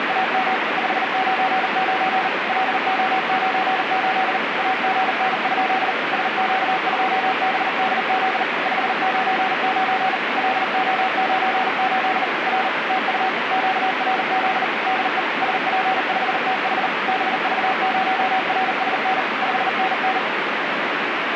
Morse code, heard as a keyed tone, machine-sent, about 39 wpm, 760 Hz, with heavy radio static. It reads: … 599 LO98 AGN? SQ2BDZ 599 LO98 R TU QRZ DE SP5TH BV0RSN 5NN